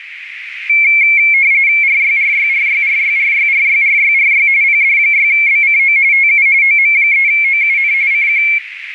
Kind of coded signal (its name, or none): RTTY